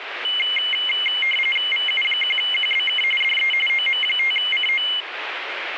RTTY (45.45 baud, 850 Hz shift), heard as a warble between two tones, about 2550 Hz centre, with radio static. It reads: VU1QBK DE OM5CO